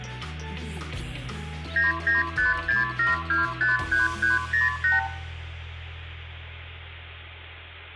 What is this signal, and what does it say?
Multi-frequency trunk signalling (R2, with the far end's replies), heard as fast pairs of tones, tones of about 150 ms, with room echo. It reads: 99567253308